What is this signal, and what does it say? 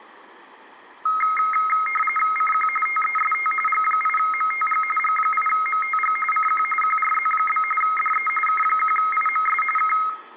RTTY (45.45 baud, 850 Hz shift), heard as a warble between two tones, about 1700 Hz centre, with room echo. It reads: CQ TEST G8MTG G8MTG CQ QRZ? DE K1IMS K